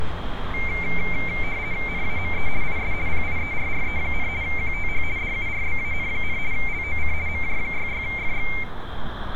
RTTY (50 baud, 170 Hz shift), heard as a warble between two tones, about 2200 Hz centre, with street noise. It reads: NAME IS PIERRE, QTH DURBAN, LOC MJ66FX